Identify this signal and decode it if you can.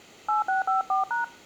DTMF, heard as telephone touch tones, dialled by hand, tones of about 140 ms. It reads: 8654#